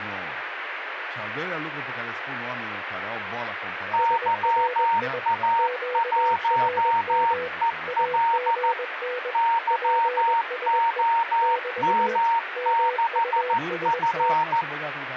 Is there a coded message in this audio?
Yes: Morse code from 3.9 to 14.7 s, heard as two keyed tones, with radio static and speech in Romanian. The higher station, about 14 wpm, 920 Hz: YA1EL YOM6F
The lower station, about 21 wpm, 500 Hz: SRI QRM AGN PSE <BT> MUST